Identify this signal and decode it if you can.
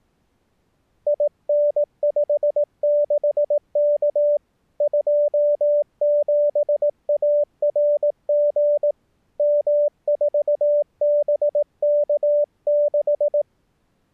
Morse code, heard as a keyed tone, hand-sent with a paddle, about 18 wpm, 590 Hz. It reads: IN56K 27ARG M4BK6